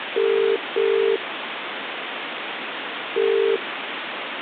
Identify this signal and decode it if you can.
Telephone call progress tone (as in the UK, Ireland, Australia and similar networks), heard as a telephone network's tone, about 400, 450 Hz, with phone line noise. Ringback tone.